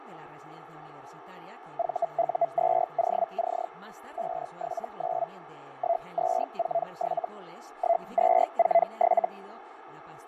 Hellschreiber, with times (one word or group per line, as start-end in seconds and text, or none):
1.8-3.7 VU2OC
4.2-5.3 579
5.8-7.3 1247
7.8-9.3 1247